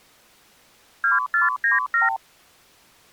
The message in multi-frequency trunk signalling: 2497

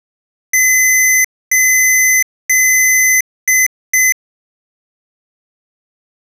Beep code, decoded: 3 long, 2 short

